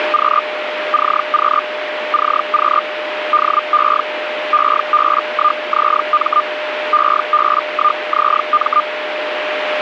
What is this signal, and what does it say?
Hellschreiber (Feld-Hell, 122.5 baud), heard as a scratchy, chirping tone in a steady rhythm, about 1210 Hz, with radio static and a steady whistle near 610 Hz. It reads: … CQ CQ DE EB1ZM EB1ZM